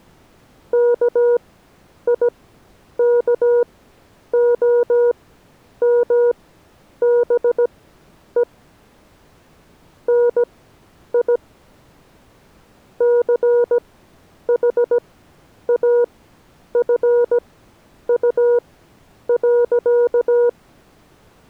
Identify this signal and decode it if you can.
Morse code, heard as a keyed tone, machine-sent, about 17 wpm, spaced as for 9 wpm, 480 Hz. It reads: KIKOMBE NI CHAFU.